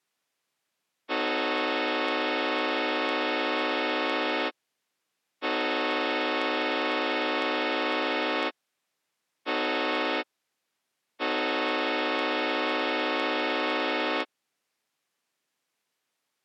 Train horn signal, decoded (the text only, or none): 2 long, 1 short, 1 long